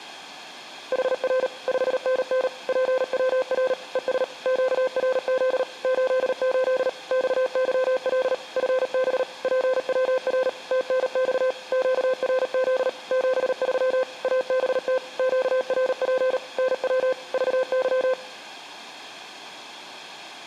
Morse code, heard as a keyed tone, machine-sent, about 38 wpm, 520 Hz. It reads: HR 5NN PWR ES QRZ 88 XYL FB PWR TNX QRZ 73 ABT QRP NW VY